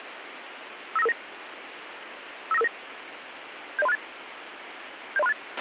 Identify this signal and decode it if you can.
Five-tone selective call (EIA), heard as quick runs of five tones, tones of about 30 ms, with radio hiss and a squelch burst at the end. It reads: 59559 59559 70368 70368